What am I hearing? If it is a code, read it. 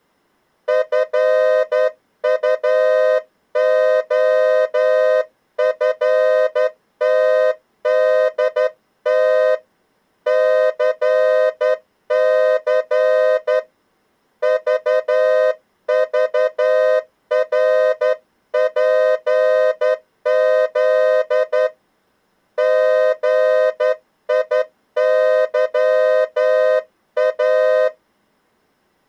Morse code, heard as a horn, hand-sent with a straight key, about 11 wpm. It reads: FUOFTDT CC VVRPZ GIYA